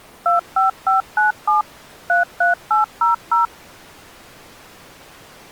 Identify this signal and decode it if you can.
DTMF, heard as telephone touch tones, dialled by machine, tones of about 140 ms. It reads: 25597 33800